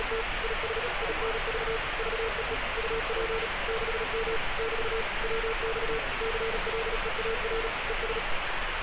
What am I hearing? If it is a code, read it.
Morse code, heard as a keyed tone, machine-sent, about 37 wpm, 450 Hz, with radio static and street noise. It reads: … IS INV VEE UP 6M <BT> WX CLEAR ES